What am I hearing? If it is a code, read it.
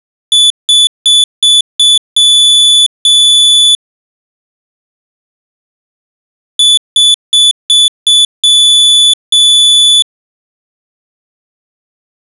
Beep code, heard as a piezo beeper, played twice, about 3450 Hz. 5 short, 2 long.